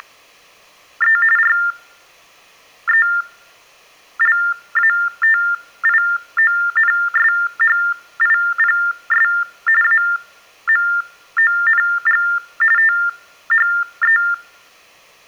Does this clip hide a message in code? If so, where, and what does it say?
Yes: TTY/TDD text telephone tones (45.45 baud Baudot) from 0.0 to 14.3 s, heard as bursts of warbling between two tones, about 400 Hz shift, 1600 Hz centre. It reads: … RELATIONSHIPS AMONG THE